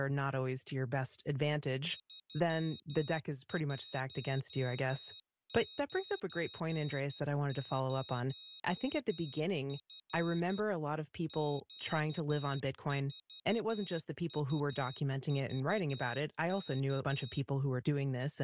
Morse code, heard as a high beeper, machine-sent, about 12 wpm, 3800 Hz, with speech in English. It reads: 3190F Q4UVK